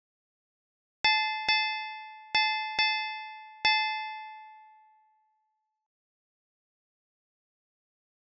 Ship's bell, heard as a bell. 5. Five half-hours of the watch have passed.